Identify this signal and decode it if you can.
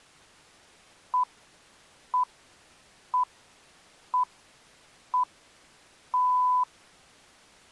Radio time signal (six pips, as the Greenwich Time Signal), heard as pips.